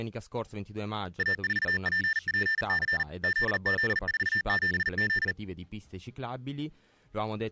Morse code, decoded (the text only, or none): A4PPC ZZ47Z